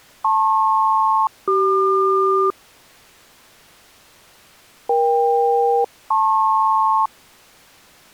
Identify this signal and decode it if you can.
Aircraft SELCAL, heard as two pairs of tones. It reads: LP-CQ EK-LP